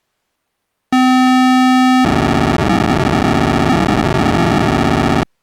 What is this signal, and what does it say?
POCSAG pager data (512 baud), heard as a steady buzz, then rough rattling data.